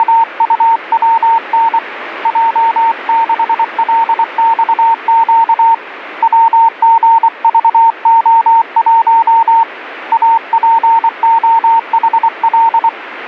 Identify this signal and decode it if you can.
Morse code, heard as a keyed tone, hand-sent with a paddle, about 24 wpm, 910 Hz, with radio static. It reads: … J6LXQ WGVO1 APOHL